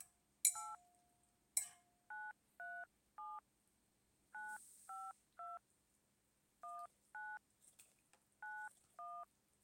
DTMF, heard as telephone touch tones, dialled by hand, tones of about 220 ms. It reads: 8 937 952 19 91